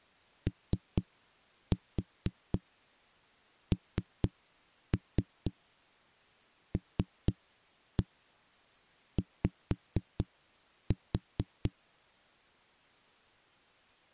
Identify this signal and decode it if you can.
Tap code, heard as knocks on a wall, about 4 knocks a second. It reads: ONLY